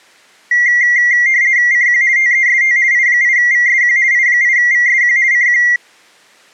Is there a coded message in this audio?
Yes: RTTY (50 baud, 170 Hz shift) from 0.5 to 5.8 s, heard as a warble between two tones, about 2000 Hz centre. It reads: CQ TEST I8VSQ I8VSQ CQ